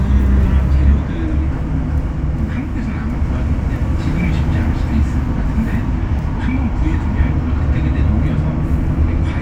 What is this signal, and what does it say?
The noise inside a bus. There is no code.